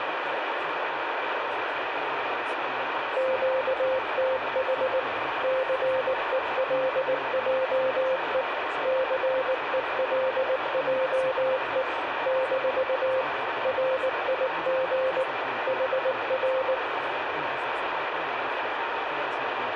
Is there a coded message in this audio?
Yes: Morse code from 3.1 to 16.8 s, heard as a keyed tone, machine-sent, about 19 wpm, 520 Hz, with radio static and room echo. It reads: QTH CELJE CELJE - RIG HR